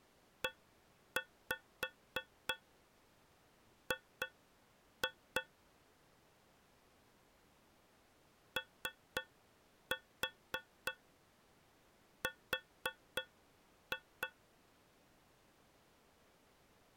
Tap code, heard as taps on a metal pipe, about 3 knocks a second. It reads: EG OR